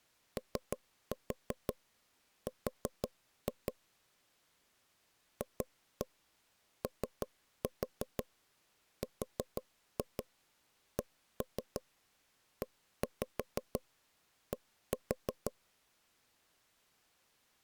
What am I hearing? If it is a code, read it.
Tap code, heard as knocks on wood, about 5 knocks a second. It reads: OR FORCED